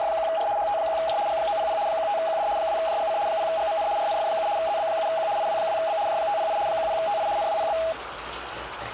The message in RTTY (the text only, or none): … HT1J G900 15QD 2JGC 0GMN RNF7 ZB7Q IW2B J508 10TI NWPB